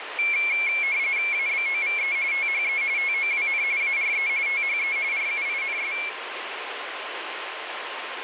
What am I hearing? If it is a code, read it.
RTTY (45.45 baud, 170 Hz shift), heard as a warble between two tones, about 2250 Hz centre, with radio static. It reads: ABOVE THE TOWN ARE THE RUINS